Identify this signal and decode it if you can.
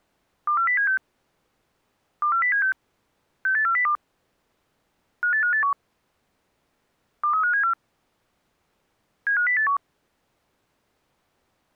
Five-tone selective call (CCIR), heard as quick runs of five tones, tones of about 100 ms. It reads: 24076 24076 68402 58581 23574 75081